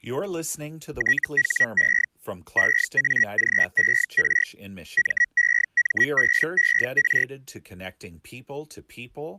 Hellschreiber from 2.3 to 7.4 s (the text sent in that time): EAGER MEMBER